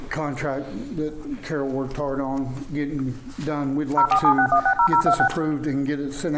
DTMF, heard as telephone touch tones, dialled by machine, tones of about 80 ms, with room echo. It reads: 0476160026